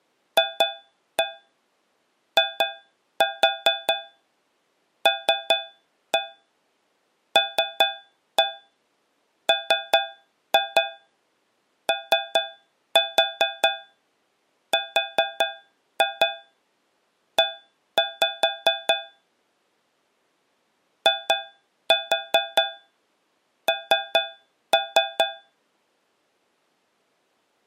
Tap code, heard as taps on a metal pipe, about 4 knocks a second. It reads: FILLMORE IN